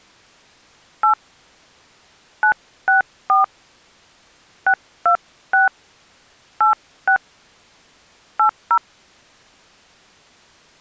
DTMF, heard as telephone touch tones, dialled by hand, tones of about 100 ms. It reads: 8 964 626 86 80